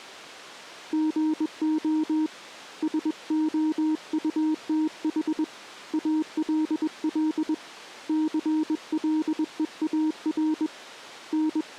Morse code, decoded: GO SOUTH ALL CLEAR …

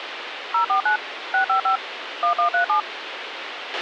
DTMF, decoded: 049 655 1137

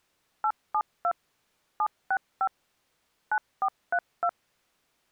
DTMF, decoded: 872 765 9432

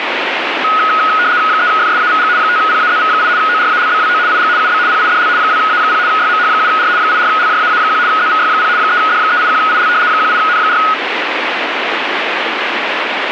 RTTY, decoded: 3FSAVG 5PAZV8 ORALBWO IG UB PIDL 2A0 YMH7R 84LJAA1 ZVY0 3D381IL 18N4

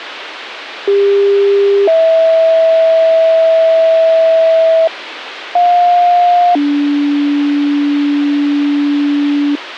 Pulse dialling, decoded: none

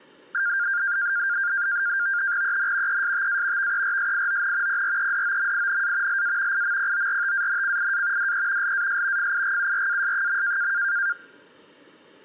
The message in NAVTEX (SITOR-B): EN ESTA VERSION PREDOMINA LA IMPORTANCIA DE LAS FIGURAS.

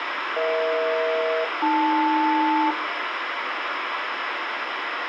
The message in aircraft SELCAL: EH-AL

